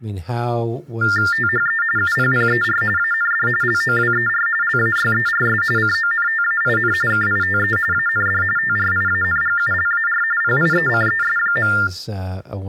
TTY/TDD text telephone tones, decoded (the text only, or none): THE UPPER AND LOWER LAYERS CONTAIN KITE AND TRIANGULAR PIECES.